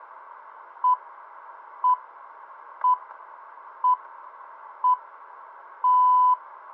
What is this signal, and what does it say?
Radio time signal (six pips, as the Greenwich Time Signal), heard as pips, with radio static and static crashes.